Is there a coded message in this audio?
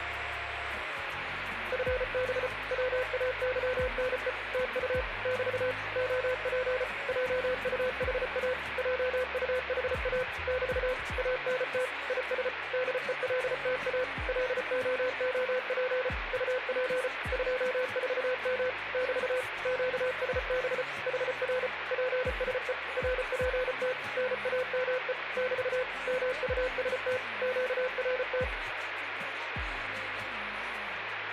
Yes: Morse code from 1.7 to 28.5 s, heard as a keyed tone, machine-sent, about 34 wpm, 510 Hz, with radio static. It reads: FB WAYNE TU <BT> OP JUHA JUHA <BT> ANT IS DELTA LOOP UP 24M <BT> QSB HR PSE RPT NAME <BT> MUST QRT